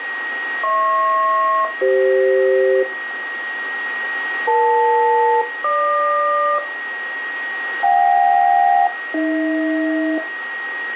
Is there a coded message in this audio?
Yes: aircraft SELCAL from 0.6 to 10.2 s, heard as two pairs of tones, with radio static and a steady whistle near 1890 Hz. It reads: HP-CF EL-GQ JK-AH